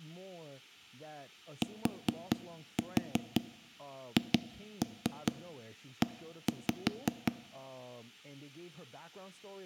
Tap code, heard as knocks on wood, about 5 knocks a second, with speech in English. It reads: THE